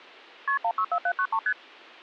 Multi-frequency trunk signalling (R1, as on North American trunks), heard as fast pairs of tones, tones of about 70 ms. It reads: KP 164793 ST